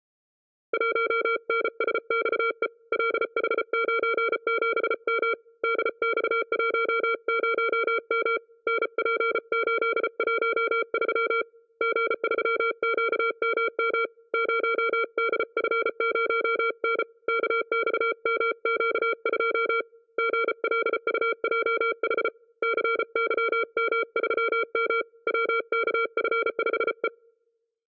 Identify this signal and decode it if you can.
Morse code, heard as a keyed tone, hand-sent with a paddle, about 34 wpm, 460 Hz, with room echo. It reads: 1NSXE LH97M DX10M NP813 G3QMM 0DF0N KXMQ2 GLUJH CYM3M WKF5E